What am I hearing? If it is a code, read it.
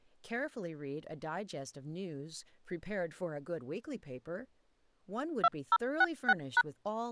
DTMF, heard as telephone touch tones, dialled by machine, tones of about 50 ms, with speech in English. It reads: 2066#